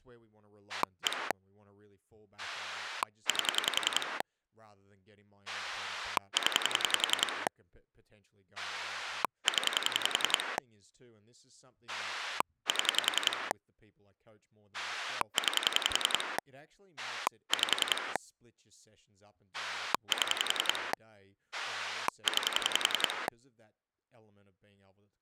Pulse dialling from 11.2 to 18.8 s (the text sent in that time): 7 9 5